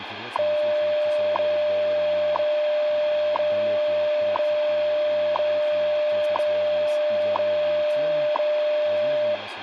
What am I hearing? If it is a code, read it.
Radio time signal (WWV, Colorado), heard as ticks, one a second, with radio static and speech in Russian.